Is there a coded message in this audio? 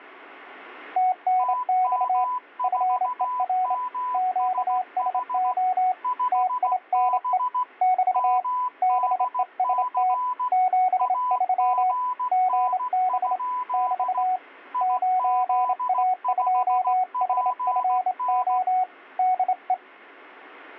Yes: Morse code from 0.9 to 19.8 s, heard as two keyed tones. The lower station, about 27 wpm, 740 Hz: TNX FER QSO TINE <BT> BEST 73 GB <BT> 9A2HFO DE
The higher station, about 16 wpm, 1000 Hz: TM4MSH 5B MDC AGN? IZ5PN